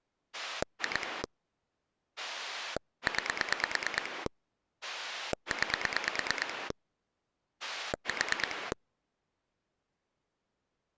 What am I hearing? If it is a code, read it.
Pulse dialling, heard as a rotary dial, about 9 pulses a second. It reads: 2 9 9 4